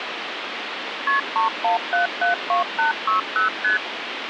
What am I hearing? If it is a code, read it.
Multi-frequency trunk signalling (R1, as on North American trunks), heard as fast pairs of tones, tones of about 130 ms, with phone line noise. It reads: KP 31772860 ST